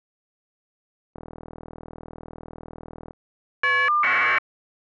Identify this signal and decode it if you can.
Caller ID data burst, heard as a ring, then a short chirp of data, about 1200 baud.